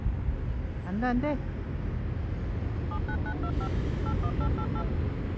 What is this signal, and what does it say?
DTMF, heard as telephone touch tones, dialled by machine, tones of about 70 ms, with street noise. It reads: 79925 81888